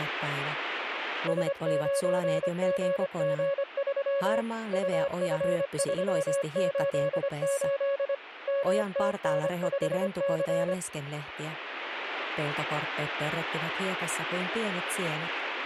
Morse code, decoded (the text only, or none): S9GG3 UF388 MTN5C